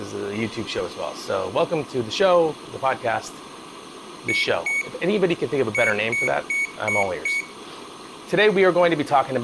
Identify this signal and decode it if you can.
Beep code, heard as a piezo beeper, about 2250 Hz, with room echo and speech in English. 2-5.